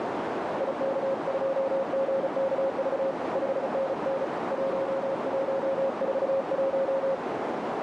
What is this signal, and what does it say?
Morse code, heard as a keyed tone, hand-sent with a paddle, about 35 wpm, 540 Hz, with heavy radio static and a narrow filter. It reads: IK2GKV 5NN 1141